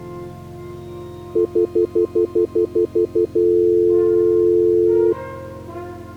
Telephone call progress tone (North American plan), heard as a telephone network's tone, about 350, 440 Hz, 0.1 s on and 0.1 s off. Stutter dial tone.